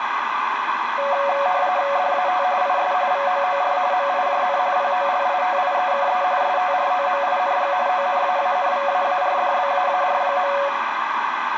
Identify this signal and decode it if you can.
RTTY (45.45 baud, 170 Hz shift), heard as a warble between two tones, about 650 Hz centre, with radio static. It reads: DAT IS VOOR MIJN POLITIEKE STROMING ONAANVAARDBAAR.